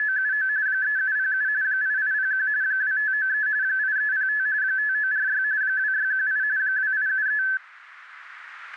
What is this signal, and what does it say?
RTTY (45.45 baud, 170 Hz shift), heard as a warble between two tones, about 1650 Hz centre. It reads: … 3707 8801 2593 8305 5946 2618 2873